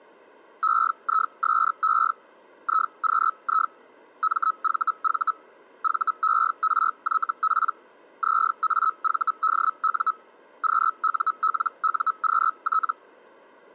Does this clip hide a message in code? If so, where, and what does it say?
Yes: Hellschreiber (Feld-Hell, 122.5 baud) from 0.6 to 12.9 s, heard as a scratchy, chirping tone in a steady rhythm, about 1290 Hz. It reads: EISE IQI MVV VERYP ZAVDU QULUQT